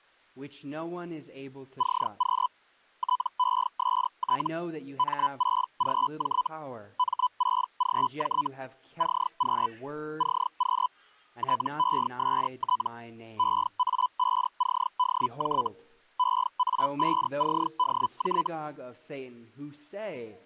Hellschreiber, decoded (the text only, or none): CQ TEST M6GJ M6GJ CQ CQ TEST EA5CDJ EA5CDJ